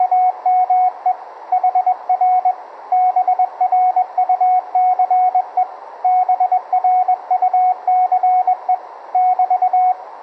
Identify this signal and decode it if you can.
Morse code, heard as a keyed tone, hand-sent with a paddle, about 21 wpm, 740 Hz, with radio static. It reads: … HR BRUCE BRUCE <BT>